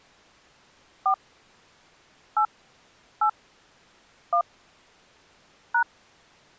DTMF, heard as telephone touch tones, dialled by hand, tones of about 90 ms. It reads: 4 8 8 1 #